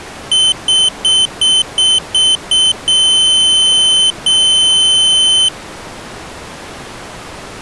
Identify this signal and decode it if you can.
Beep code, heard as a piezo beeper, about 3050 Hz. 7 short, 2 long.